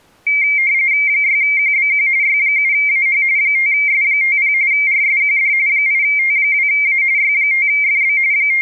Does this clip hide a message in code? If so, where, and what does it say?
Yes: RTTY (45.45 baud, 170 Hz shift) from 0.3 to 8.6 s, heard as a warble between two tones, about 2200 Hz centre. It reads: 6QBQ Y7AH 5S50 RSQD 8T2A Y5FB …